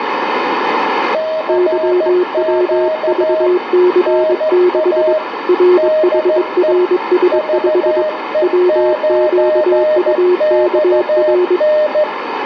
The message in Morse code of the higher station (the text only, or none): CQ NA DE VE9XN